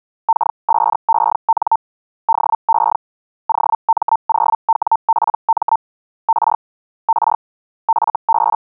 Hellschreiber (Feld-Hell, 122.5 baud), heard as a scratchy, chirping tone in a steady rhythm, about 900 Hz. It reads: K5EN DE OM0WPM R R FB